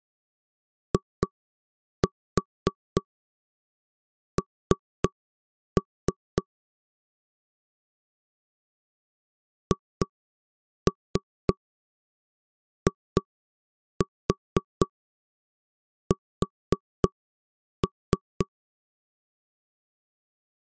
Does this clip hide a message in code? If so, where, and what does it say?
Yes: tap code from 0.9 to 18.5 s, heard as knocks on wood, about 3 knocks a second. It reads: IN HIS